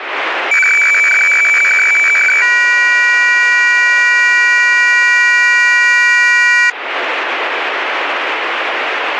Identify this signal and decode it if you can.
Weather fax (radiofax), 120 lines a minute, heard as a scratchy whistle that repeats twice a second, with radio static.